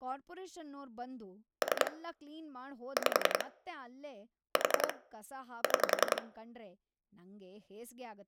Pulse dialling, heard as clicks on a phone line, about 10 pulses a second, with room echo and speech in Kannada. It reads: 3 5 4 6